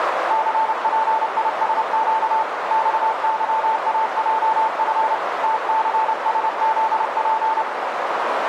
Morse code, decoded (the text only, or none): CPISQ XYAJF TCSZP